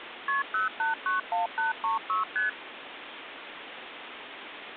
Multi-frequency trunk signalling (R1, as on North American trunks), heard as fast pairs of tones, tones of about 140 ms, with phone line noise. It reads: KP 0891836 ST